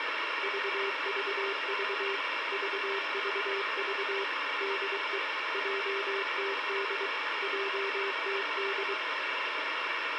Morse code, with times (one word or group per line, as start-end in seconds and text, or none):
0.4-2.2 VVV
2.5-4.2 VVV
4.6-5.2 DE
5.5-7.1 JTD
7.4-8.9 JTD